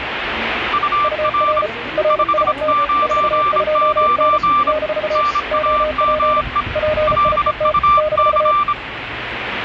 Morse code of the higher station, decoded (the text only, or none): UR 599 NAME LUC